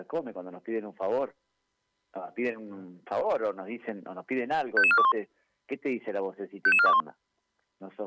Five-tone selective call (ZVEI), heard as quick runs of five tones, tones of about 70 ms. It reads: 55421 55421